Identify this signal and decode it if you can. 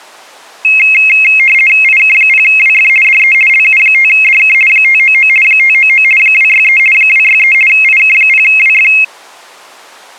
RTTY (50 baud, 450 Hz shift), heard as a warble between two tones, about 2350 Hz centre. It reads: IK0WF DE LU5DK 599 599 263 263 IK0WF